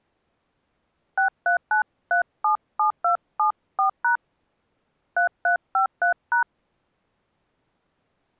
DTMF, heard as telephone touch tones, dialled by hand, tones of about 110 ms. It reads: 639377274# 3353#